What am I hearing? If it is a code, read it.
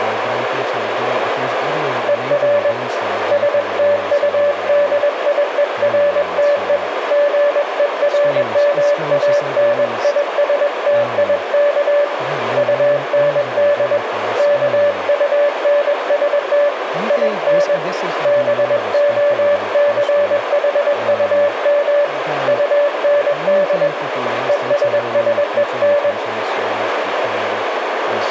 Morse code, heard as a keyed tone, hand-sent with a paddle, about 21 wpm, 580 Hz, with radio static, a narrow filter, room echo and speech in English. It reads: ER STUDIERTE GERMANISTIK UND KUNST IN BOCHUM UND ESSEN